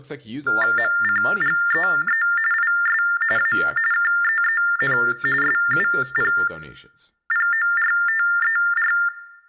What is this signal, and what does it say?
TTY/TDD text telephone tones (45.45 baud Baudot), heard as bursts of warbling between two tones, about 400 Hz shift, 1600 Hz centre, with speech in English. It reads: MCGEE IS A KEEN SUPPORTER